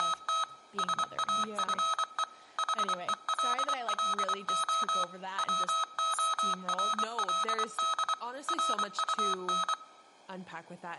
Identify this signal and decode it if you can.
Morse code, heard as electronic beeps, machine-sent, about 24 wpm, 1280 Hz, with room echo and speech in English. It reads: … SAFE HELLO WORLD RUN